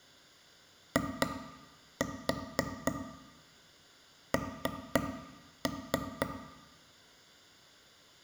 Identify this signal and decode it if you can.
Tap code, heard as taps on a table, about 4 knocks a second, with room echo. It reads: IN